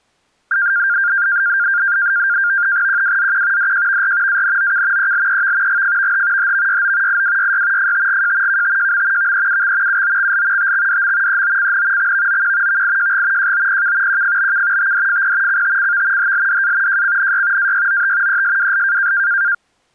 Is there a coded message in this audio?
Yes: NAVTEX (SITOR-B), 100 baud, 170 Hz shift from 0.5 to 19.5 s, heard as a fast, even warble, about 1500 Hz centre. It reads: QWZQ DJVR ANOK ELEV GFVH HVYO IWYY FTGJ KTJM VEUX UOXL TXDM EOCN XVOQ VIJG JOPK QFBK TDFP CTCV HLDA JCNY AYOT ESWL